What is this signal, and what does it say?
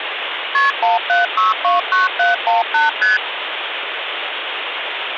Multi-frequency trunk signalling (R1, as on North American trunks), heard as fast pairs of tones, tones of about 150 ms, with phone line noise. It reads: KP 17629718 ST